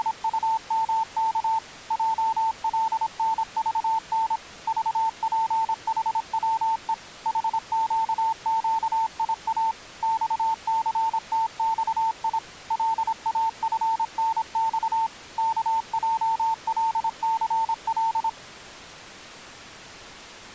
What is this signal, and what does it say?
Morse code, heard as a keyed tone, machine-sent, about 26 wpm, 900 Hz. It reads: … JLNVN VPHWE HQQIA XCTXI LAFNX KJLCL